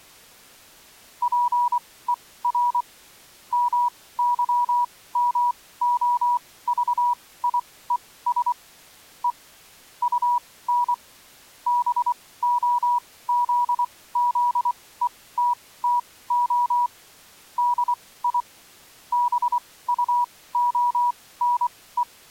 Morse code, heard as a keyed tone, machine-sent, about 24 wpm, spaced as for 17 wpm, 970 Hz. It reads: PER MYMOVIES E UN BOZZETTO DI BUONE